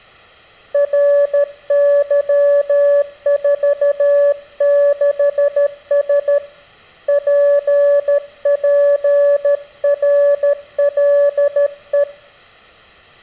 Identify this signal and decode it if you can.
Morse code, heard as a keyed tone, hand-sent with a paddle, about 13 wpm, 570 Hz. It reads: RY46S PPRLE